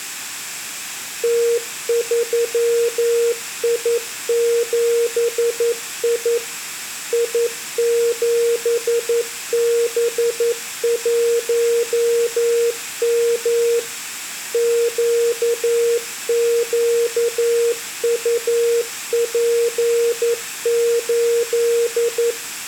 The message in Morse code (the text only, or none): T3I7I I7B1M QQUP8